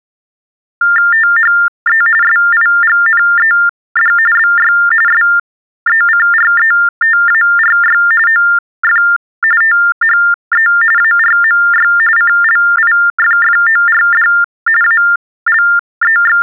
TTY/TDD text telephone tones (45.45 baud Baudot), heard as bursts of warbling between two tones, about 400 Hz shift, 1600 Hz centre. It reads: THE SIGNED BY SECRETARY OF THE ARMY CLIFFORD …